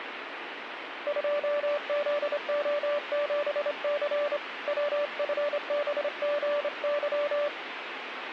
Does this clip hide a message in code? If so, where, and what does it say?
Yes: Morse code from 1.0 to 7.5 s, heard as a keyed tone, hand-sent with a straight key, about 27 wpm, 580 Hz, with radio static. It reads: 2ZO7C WFBGY